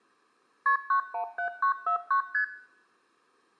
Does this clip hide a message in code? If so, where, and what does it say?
Yes: multi-frequency trunk signalling (R1, as on North American trunks) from 0.7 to 2.4 s, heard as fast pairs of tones, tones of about 100 ms. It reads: KP 917949 ST